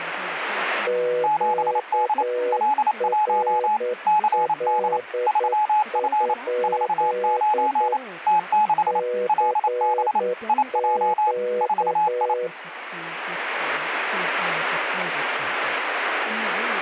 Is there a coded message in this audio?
Yes: Morse code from 0.8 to 12.5 s, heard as two keyed tones, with radio static. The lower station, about 9 wpm, 490 Hz: QRL? CQ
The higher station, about 28 wpm, 850 Hz: 7D L1 CD 3F 49 T6 LB IJ 4I